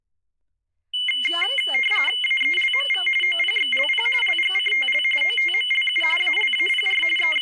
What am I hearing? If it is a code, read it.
RTTY (45.45 baud, 850 Hz shift), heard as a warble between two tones, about 2550 Hz centre, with speech in Gujarati. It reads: AELMV OPXLP LGCTL OTMLU ALAPR …